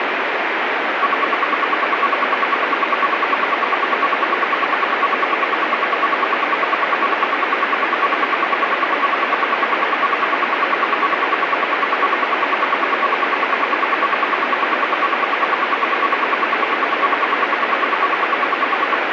Radio time signal (RWM, Moscow), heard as ten pulses a second, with radio static.